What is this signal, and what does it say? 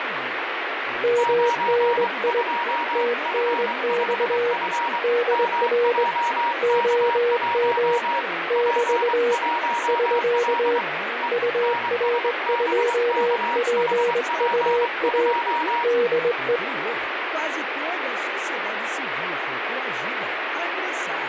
Morse code, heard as two keyed tones, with radio static and speech in Portuguese. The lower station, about 21 wpm, 480 Hz: MNI TNX DR OM <BT> <SK> UR2PUA DE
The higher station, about 23 wpm, 950 Hz: 92F5F MJK1 P1L E NSBKHP2